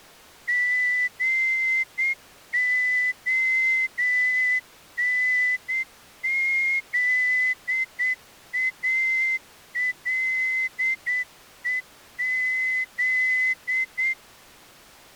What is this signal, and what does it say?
Morse code, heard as a whistle, hand-sent with a straight key, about 8 wpm. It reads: GONZALEZ